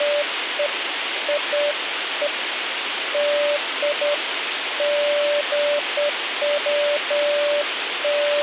Beeps of irregular length, with phone line noise. There is no code.